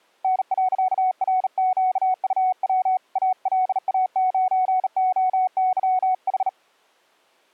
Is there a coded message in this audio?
Yes: Morse code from 0.2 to 6.6 s, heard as a keyed tone, hand-sent with a bug key, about 38 wpm, 740 Hz. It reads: N.RQUW ALA9OYH